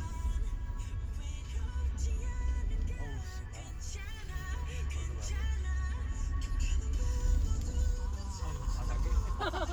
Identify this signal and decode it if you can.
The noise inside a car. There is no code.